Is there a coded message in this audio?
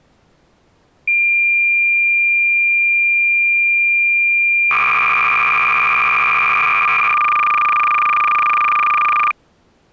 Yes: cassette data (Kansas City type), 300 baud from 1.1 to 9.3 s, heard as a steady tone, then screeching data.